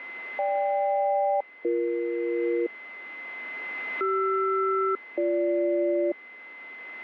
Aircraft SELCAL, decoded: GK-BE CR-BG

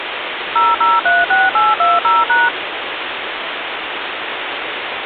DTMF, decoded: 0036820#

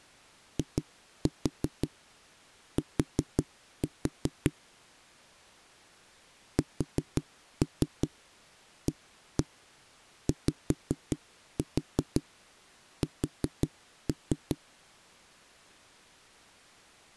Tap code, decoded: IT SAYS

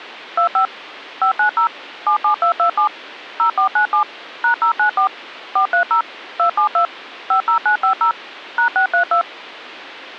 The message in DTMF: 25 590 77227 0497 #094 430 272 50950 #632

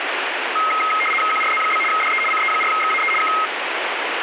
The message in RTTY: QRZ? DE CE4XAE K

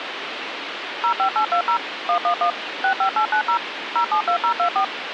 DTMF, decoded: 05820 111 65890 072024

